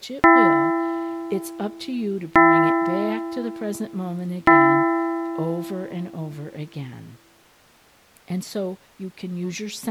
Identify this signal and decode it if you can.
Clock strike, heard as a bell, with speech in English. 3. Three o'clock.